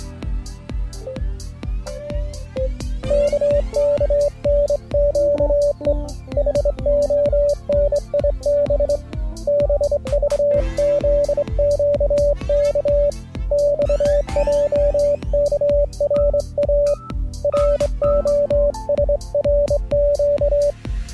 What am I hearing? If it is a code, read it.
Morse code, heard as a keyed tone, hand-sent with a straight key, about 24 wpm, 580 Hz. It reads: KKNQE HONIB BVZQK XJKRA ROSRQ